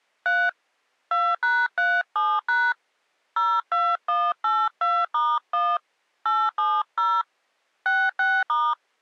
DTMF, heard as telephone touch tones, dialled by hand, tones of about 240 ms. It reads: 3 2#37# 02182*1 870 66*